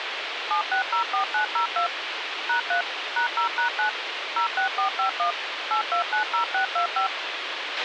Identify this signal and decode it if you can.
DTMF, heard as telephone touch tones, dialled by machine, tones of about 110 ms, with radio hiss and a squelch burst at the end. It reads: 7604902 #3 #0#9 06451 8290625